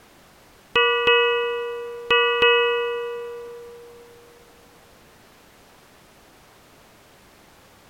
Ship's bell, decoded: 4

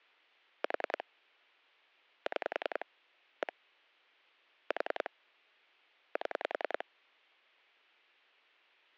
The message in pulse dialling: 4 6 1 4 7

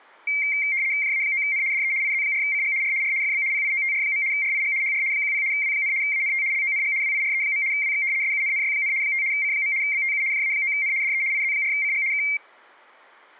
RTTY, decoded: JA9N DE IZ4CG R R FB PIOTR. RIG HR 10 W, ANT LONG WIRE. WX SUNNY, 5 C. BTU JA9N DE IZ4CG K

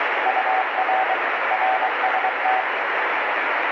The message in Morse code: UR RST

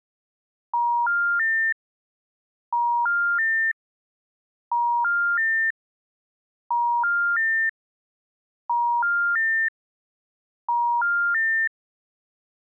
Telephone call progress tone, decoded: special information tone

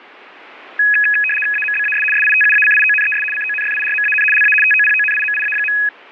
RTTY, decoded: AMBAS SITUACIONES CONFIRMAN LA TOPONIMIA.

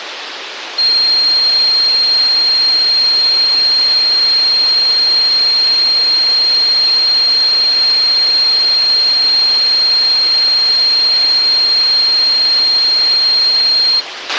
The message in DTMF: none

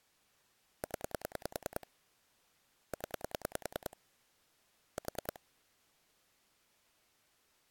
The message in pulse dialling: 0 0 4

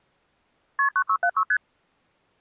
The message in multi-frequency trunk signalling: KP 9676 ST

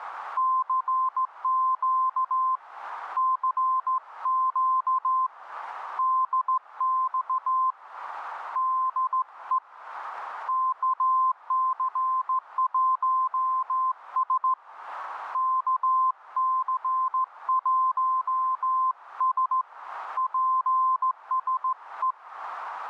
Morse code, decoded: CQ CQ DX DE KC1S KC1S PSE

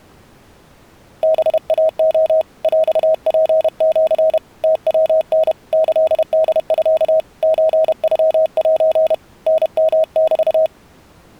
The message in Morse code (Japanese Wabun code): ハイレ ヰツシ ムヤタ キホミ ソノセ タヨメ

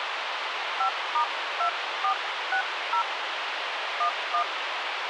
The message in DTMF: 5*2460 11

